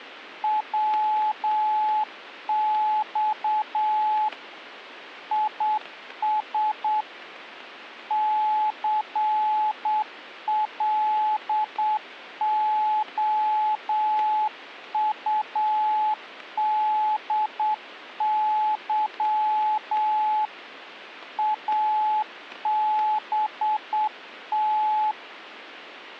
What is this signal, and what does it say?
Morse code, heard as a keyed tone, hand-sent with a straight key, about 8 wpm, 860 Hz, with static crashes. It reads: WX IS CLOUDY ABT